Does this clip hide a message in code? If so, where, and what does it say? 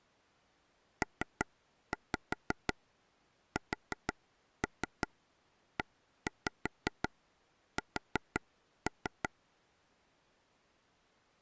Yes: tap code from 1.0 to 9.3 s, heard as taps on a table, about 5 knocks a second. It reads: PSES